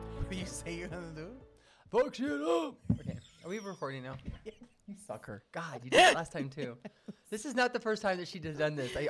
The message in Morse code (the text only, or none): none